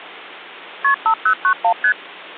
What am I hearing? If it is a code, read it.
Multi-frequency trunk signalling (R1, as on North American trunks), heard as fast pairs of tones, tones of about 80 ms. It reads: KP 5091 ST